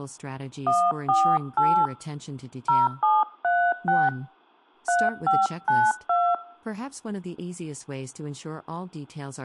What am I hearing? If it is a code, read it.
DTMF, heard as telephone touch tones, dialled by hand, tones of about 240 ms, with speech in English. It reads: 148 0736 3592